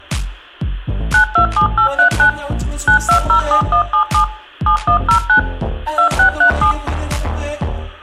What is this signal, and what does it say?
DTMF, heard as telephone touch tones, dialled by machine, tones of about 100 ms, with room echo. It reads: 927839 9207177 7109 2637